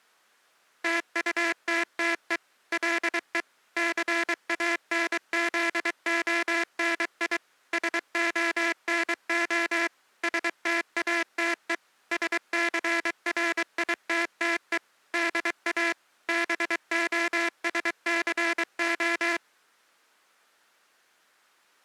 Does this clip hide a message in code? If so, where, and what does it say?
Yes: Morse code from 0.8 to 19.4 s, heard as a buzzer, machine-sent, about 23 wpm. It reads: TUTTE LE CANZONI SONO STATE SCRITTE DA BOSCO